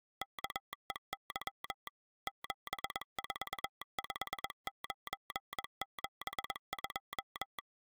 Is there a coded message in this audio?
Yes: Morse code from 0.2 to 7.6 s, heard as a telegraph sounder, machine-sent, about 21 wpm. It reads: KEY 745972